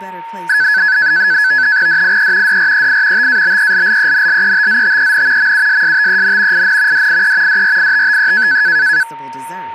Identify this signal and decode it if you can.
NAVTEX (SITOR-B), 100 baud, 170 Hz shift, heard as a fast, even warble, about 1600 Hz centre, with a steady whistle near 920 Hz and speech in French. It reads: DIE DREI TABELLENLETZTEN MUSSTEN IN DIE DRITTE